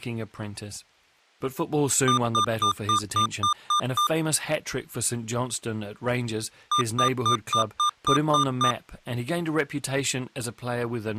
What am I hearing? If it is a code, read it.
Beep code, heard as beeps from a small speaker, played twice, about 1200 Hz, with speech in English. 8 short. In AMI BIOS tables: display memory failure; in Dell tables: LCD failure.